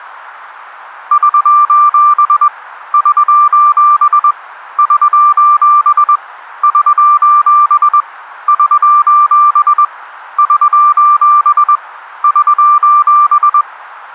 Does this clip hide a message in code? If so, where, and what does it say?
Yes: Morse code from 1.1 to 13.7 s, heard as a keyed tone, hand-sent with a paddle, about 21 wpm, 1180 Hz. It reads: <SOS> <SOS> <SOS> <SOS> <SOS> <SOS> <SOS>